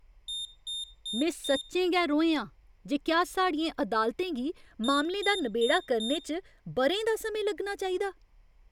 Beep code, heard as a piezo beeper, played twice, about 3650 Hz, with room echo and speech in Dogri. 4 short. In AMI BIOS tables: system timer failure; in Dell tables: memory read or write failure.